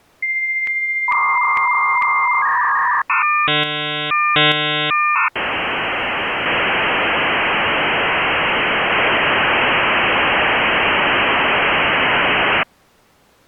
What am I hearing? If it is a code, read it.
Dial-up modem handshake (V.34 or later), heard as a whistle, warbles, then hiss.